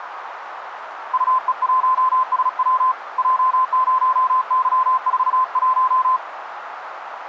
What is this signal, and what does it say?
Morse code, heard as a keyed tone, hand-sent with a paddle, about 36 wpm, 1030 Hz, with radio static and a narrow filter. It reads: UE1SW J0Y41